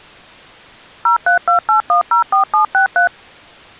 DTMF, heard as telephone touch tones, dialled by machine, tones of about 110 ms. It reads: 0328104763